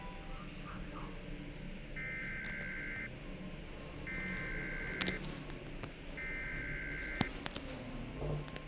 Emergency Alert System (SAME) tones (header bursts), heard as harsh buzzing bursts, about 520.83 baud, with radio hiss and the noise inside a lift.